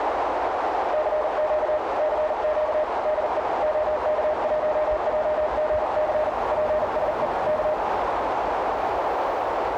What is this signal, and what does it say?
Morse code, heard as a keyed tone, hand-sent with a paddle, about 40 wpm, 610 Hz, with heavy radio static, a narrow filter and street noise. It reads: CQ CQ DE OK1JGC PSE K